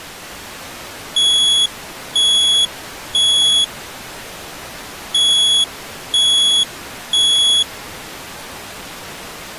Alarm pattern, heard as an alarm's beeps, played twice, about 3350 Hz. Temporal three. Smoke or fire, evacuate.